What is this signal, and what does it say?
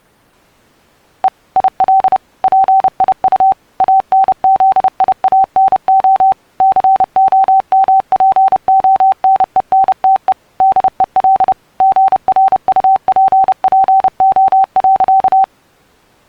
Morse code, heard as a keyed tone, machine-sent, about 30 wpm, 770 Hz. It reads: E IL PIU ANZIANO COMPONENTE DEL GRUPPO.